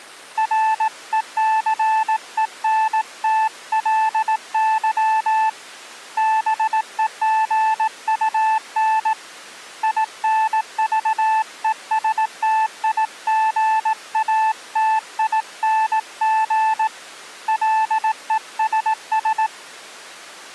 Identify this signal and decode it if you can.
Morse code, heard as a keyed tone, hand-sent with a paddle, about 18 wpm, 880 Hz. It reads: RECENTLY BEGUN INVESTIGATING LESS